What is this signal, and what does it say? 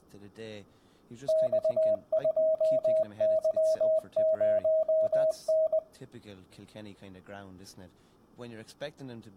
Morse code, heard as a keyed tone, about 20 wpm, 640 Hz, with room echo and speech in English. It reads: X2Y0N